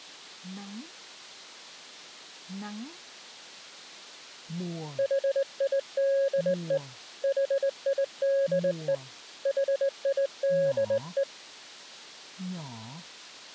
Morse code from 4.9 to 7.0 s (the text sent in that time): HIDE